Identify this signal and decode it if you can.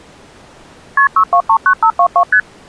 Multi-frequency trunk signalling (R1, as on North American trunks), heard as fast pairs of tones, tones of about 80 ms. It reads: KP 6239522 ST